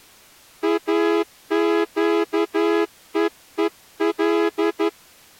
Morse code, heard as a horn, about 11 wpm. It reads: AQEEL